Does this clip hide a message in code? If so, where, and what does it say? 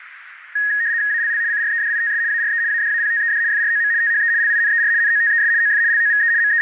Yes: RTTY (75 baud, 170 Hz shift) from 0.6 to 6.6 s, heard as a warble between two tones, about 1750 Hz centre, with radio static. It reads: ALL CREDITS ARE ADAPTED FROM THE LINER NOTES OF LOVE …